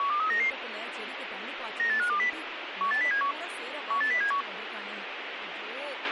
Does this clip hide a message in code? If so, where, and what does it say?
Yes: five-tone selective call (CCIR) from 0.0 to 4.4 s, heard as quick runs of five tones, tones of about 100 ms, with radio hiss, a squelch burst at the end and speech in Tamil. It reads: 12399 98520 18071 18071